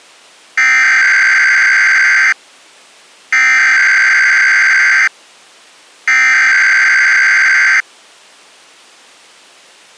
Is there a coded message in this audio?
Yes: Emergency Alert System (SAME) tones (header bursts) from 0.6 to 7.8 s, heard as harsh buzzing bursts, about 520.83 baud.